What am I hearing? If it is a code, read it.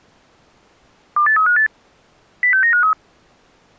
Five-tone selective call (CCIR), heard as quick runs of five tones, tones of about 100 ms. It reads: 28358 06953